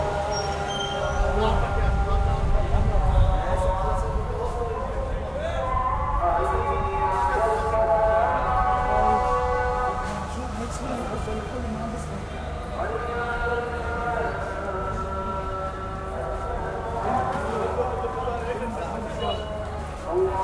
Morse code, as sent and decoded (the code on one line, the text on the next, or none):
none